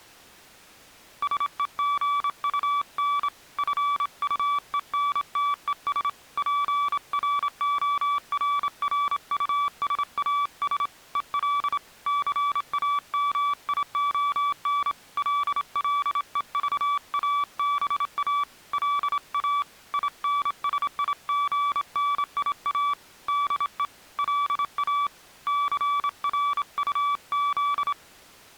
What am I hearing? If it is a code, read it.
Morse code, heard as a keyed tone, hand-sent with a straight key, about 27 wpm, 1150 Hz. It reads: SEGUN FUENTES PRORRUSAS EL CAMION LLEVABA LA INSIGNIA DE LA CRUZ